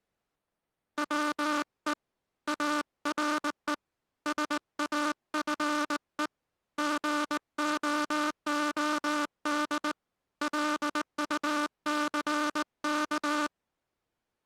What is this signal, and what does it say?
Morse code, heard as a buzzer, hand-sent with a straight key, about 19 wpm. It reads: WE ARE SAFE GOOD LUCK